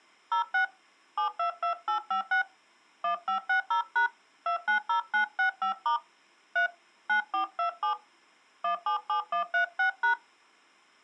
DTMF, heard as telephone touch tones, dialled by hand, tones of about 110 ms. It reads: 06 722856 1560# 290965* 3 9427 177136#